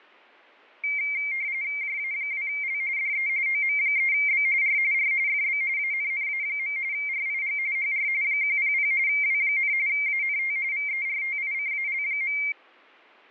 RTTY (45.45 baud, 170 Hz shift), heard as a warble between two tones, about 2200 Hz centre. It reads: JA2L DE OM3B R R FB ANNA. RIG HR 100 W, ANT VERTICAL.